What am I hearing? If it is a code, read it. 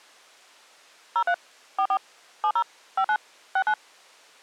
DTMF, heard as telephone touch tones, dialled by machine, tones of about 70 ms. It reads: 03 44 70 59 69